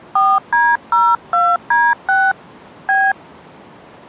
DTMF, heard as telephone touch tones, dialled by hand, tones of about 230 ms. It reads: 4D02D6 B